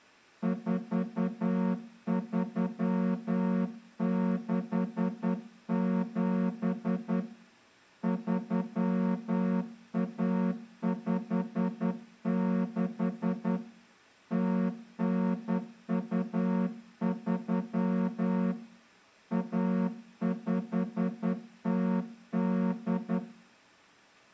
Morse code (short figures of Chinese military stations), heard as a horn, hand-sent with a straight key, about 10 wpm. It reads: 4367 3156 0923 1508